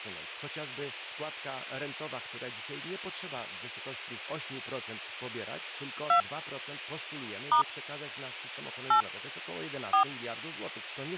DTMF, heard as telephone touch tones, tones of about 100 ms. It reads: 2 * 8 4